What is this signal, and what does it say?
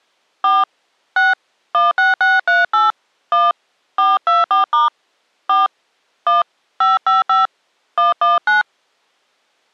DTMF, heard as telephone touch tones, dialled by hand, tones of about 170 ms. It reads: 4 6 16638 1 424* 4 1 555 119